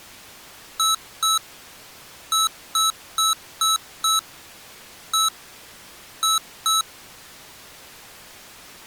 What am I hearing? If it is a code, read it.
Beep code, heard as beeps from a small speaker, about 1300 Hz. 2-5-1-2.